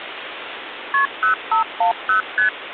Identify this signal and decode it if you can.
Multi-frequency trunk signalling (R1, as on North American trunks), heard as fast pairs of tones, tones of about 120 ms, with phone line noise. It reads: KP 0510 ST